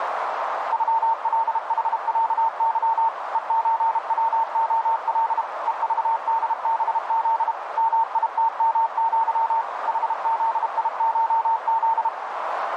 Morse code (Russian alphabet), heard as a keyed tone, machine-sent, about 32 wpm, 910 Hz, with radio static and a narrow filter. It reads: ЮЛХЯЫ ЕЧВОЛ ЕЖДБЗ МИТМЪ ХЗИШЗ